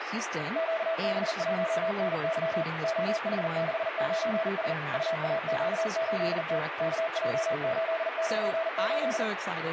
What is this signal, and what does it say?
Morse code, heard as a keyed tone, machine-sent, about 40 wpm, 650 Hz, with radio static and speech in English. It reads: QB1NY OH69S UAQ8T KJ898